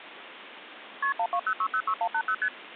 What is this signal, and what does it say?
Multi-frequency trunk signalling (R1, as on North American trunks), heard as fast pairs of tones, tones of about 70 ms, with phone line noise. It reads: KP 120606180 ST